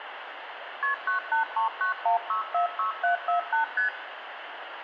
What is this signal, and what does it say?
Multi-frequency trunk signalling (R1, as on North American trunks), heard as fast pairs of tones, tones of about 120 ms, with phone line noise and room echo. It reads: KP 98391646748 ST